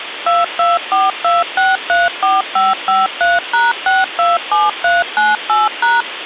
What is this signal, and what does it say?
DTMF, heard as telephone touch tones, dialled by machine, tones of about 180 ms, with phone line noise. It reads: 2242634553#627398#